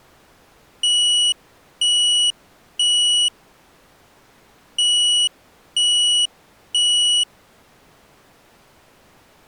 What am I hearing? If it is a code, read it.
Alarm pattern, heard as an alarm's beeps, played twice, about 2950 Hz. Temporal three. Smoke or fire, evacuate.